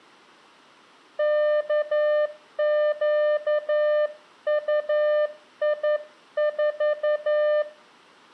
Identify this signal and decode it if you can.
Morse code, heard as a keyed tone, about 11 wpm, 600 Hz, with room echo. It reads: KQUI4